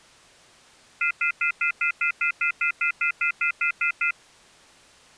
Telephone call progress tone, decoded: off-hook warning tone

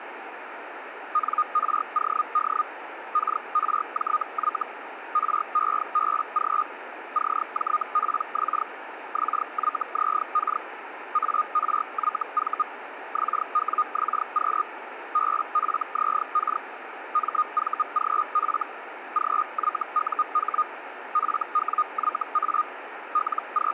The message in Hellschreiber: NROD KRJY REBG CJPX XYZK ARYV XWXQ BFZK MVGF GYUH FWYA …

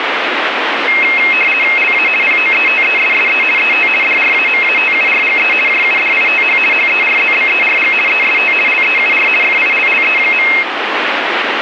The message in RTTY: LA POETESSE ET DRAMATURGE JUDITH HERZBERG EST LEUR FILLE.

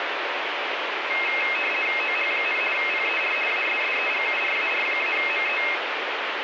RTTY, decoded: OH, PER ASSEGURAR-ME

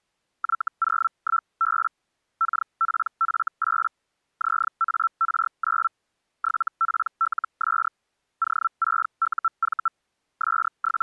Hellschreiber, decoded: Y01B KPF8 ZAR9 7PLS O6UV …

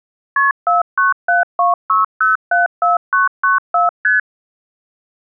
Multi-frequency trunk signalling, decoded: KP 49726074994 ST

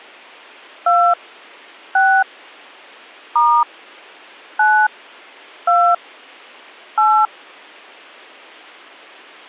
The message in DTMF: 2 6 * 9 2 8

